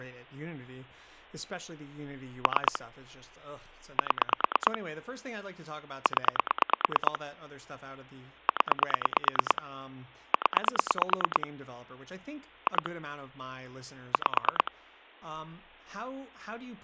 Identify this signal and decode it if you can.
Pulse dialling, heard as clicks on a phone line, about 9 pulses a second, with speech in English. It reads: 3 7 0 0 0 2 5